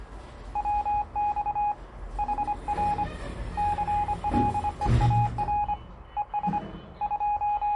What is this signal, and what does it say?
Morse code, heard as a keyed tone, hand-sent with a paddle, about 25 wpm, 830 Hz, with the noise inside a lift. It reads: WX HR CLEAR ES …